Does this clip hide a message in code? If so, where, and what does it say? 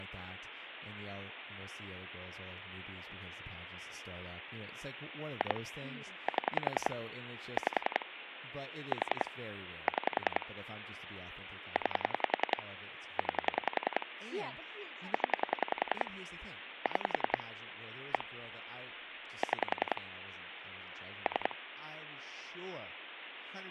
Yes: pulse dialling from 5.4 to 21.5 s, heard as clicks on a phone line, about 10 pulses a second, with phone line noise and speech in English. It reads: 2 7 5 4 6 9 9 0 6 1 6 3